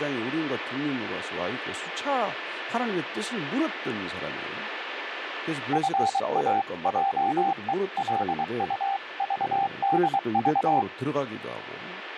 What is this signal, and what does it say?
Morse code (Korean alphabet), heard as a keyed tone, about 23 wpm, 790 Hz, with radio static, a steady whistle near 1750 Hz and speech in Korean. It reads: 노하기를